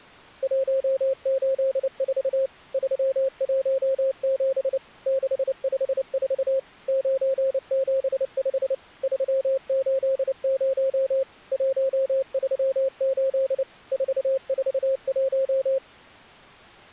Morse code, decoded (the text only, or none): 184 317 654 975 380 138 441